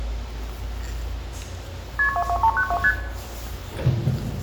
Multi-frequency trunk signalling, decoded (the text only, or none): KP 22392 ST